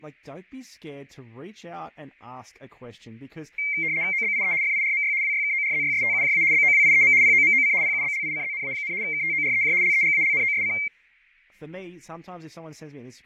RTTY (75 baud, 170 Hz shift), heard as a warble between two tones, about 2200 Hz centre, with fading and speech in English. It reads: OBIE FIRMY WYKORZYSTUJA BOWIEM POMOC PUBLICZNA, KTOREJ LEGALNOSC